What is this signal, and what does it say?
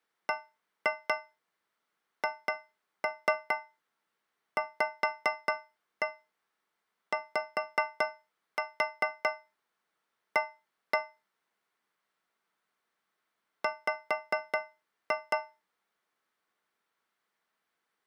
Tap code, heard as taps on a metal pipe, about 4 knocks a second. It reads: BHVYA W